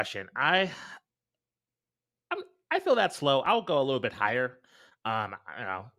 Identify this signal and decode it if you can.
Speech in English. There is no code.